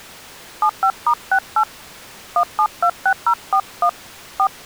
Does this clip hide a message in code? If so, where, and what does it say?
Yes: DTMF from 0.6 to 4.5 s, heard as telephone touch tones, dialled by hand, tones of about 70 ms. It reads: 75*68 1726041 4